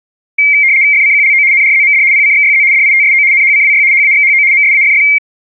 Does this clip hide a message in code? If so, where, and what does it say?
Yes: RTTY (75 baud, 170 Hz shift) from 0.4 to 5.2 s, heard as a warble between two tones, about 2200 Hz centre. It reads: FCQLO NRZMD PCXYZ DITSO NHCWY HAXHO MSAFF